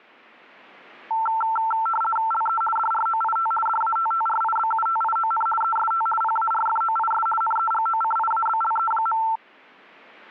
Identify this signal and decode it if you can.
RTTY (50 baud, 450 Hz shift), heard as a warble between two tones, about 1120 Hz centre. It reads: LE DROIT DATTRIBUTION EST PARFOIS NEGOCIABLE.